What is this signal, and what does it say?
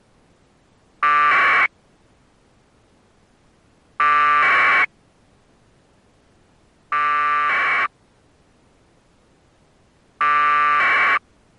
Packet radio (AX.25, as in APRS), 1200 baud, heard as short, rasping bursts.